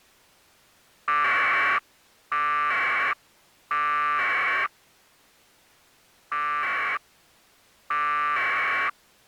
Packet radio (AX.25, as in APRS), 1200 baud, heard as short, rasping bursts.